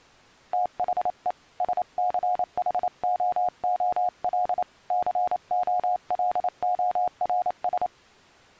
Morse code, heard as a keyed tone, hand-sent with a paddle, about 28 wpm, 720 Hz. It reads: THE SCHOOL COLORS